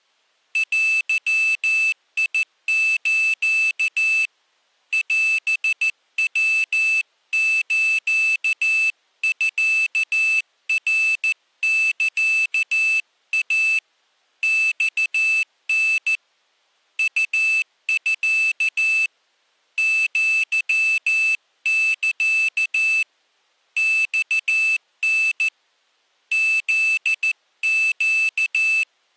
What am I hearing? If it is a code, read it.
Morse code (Japanese Wabun code), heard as a high beeper, hand-sent with a paddle, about 14 wpm, 2650 Hz. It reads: デス オヤスミナサイ マタ ウミ アサ マタ フネ